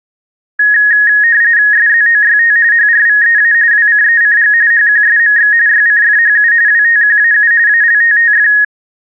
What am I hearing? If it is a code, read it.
RTTY (45.45 baud, 170 Hz shift), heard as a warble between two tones, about 1750 Hz centre. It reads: SZOYT HRVEA WCECG HQSMX YCFHU WTQAU ALTTF